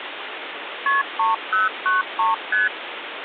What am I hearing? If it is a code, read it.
Multi-frequency trunk signalling (R1, as on North American trunks), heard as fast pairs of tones, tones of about 160 ms, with phone line noise. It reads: KP 3093 ST